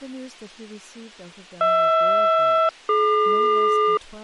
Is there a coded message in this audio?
Yes: aircraft SELCAL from 1.6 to 4.0 s, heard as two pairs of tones, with speech in English. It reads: HR-DQ